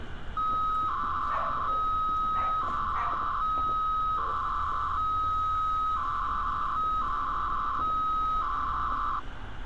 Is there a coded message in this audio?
Yes: 300-baud modem data (Bell 103 tones) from 0.4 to 9.2 s, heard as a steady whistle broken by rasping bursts, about 300 baud, 200 Hz shift, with phone line noise and street noise.